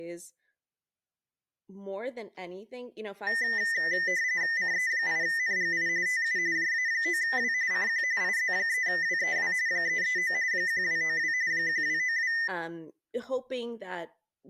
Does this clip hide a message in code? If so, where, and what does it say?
Yes: RTTY (45.45 baud, 170 Hz shift) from 3.3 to 12.5 s, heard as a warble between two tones, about 1900 Hz centre, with speech in English. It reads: CE8NGI TU JA9W CQ IZ3WEW 339 1292 1292